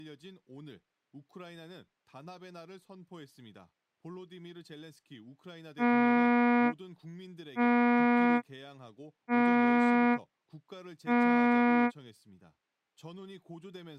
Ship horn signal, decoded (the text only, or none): 4 short